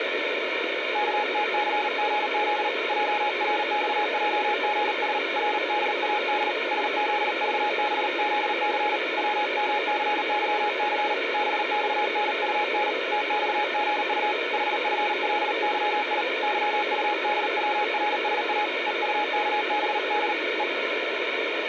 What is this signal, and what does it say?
Morse code, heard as a keyed tone, hand-sent with a paddle, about 38 wpm, 840 Hz, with radio static. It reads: KTCGZ JRXJGS RDAD SZVBZC WMCYC BXNUN TXGU HFLYI YUDWRSA EUKBD E